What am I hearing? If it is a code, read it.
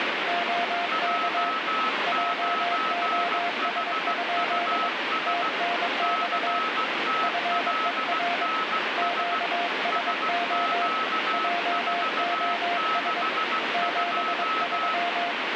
Morse code, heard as two keyed tones, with heavy radio static. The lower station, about 22 wpm, 700 Hz: OK JOS? TNX FER QSO JOS 73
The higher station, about 16 wpm, 1290 Hz: J9HUS CTLNS SQ462